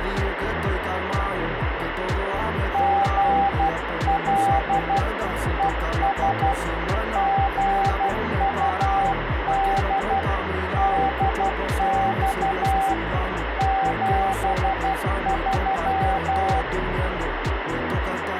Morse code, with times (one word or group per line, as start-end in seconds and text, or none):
2.7-5.0 GL
5.6-6.5 ES
7.2-10.2 GUD
10.8-12.9 DX
13.6-16.6 73